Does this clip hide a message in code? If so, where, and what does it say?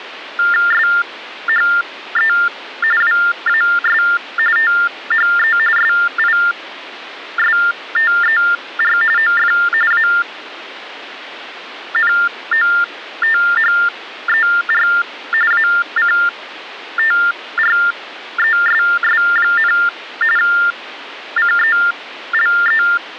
Yes: TTY/TDD text telephone tones (45.45 baud Baudot) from 0.4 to 23.0 s, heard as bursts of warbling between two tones, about 400 Hz shift, 1600 Hz centre. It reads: SHE WAS THE SISTER OF ANOTHER ACTRESS, CELE